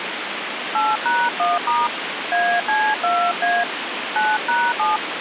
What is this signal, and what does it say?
DTMF, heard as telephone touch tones, dialled by hand, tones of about 220 ms, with phone line noise. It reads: 8#1* AC2A 9#7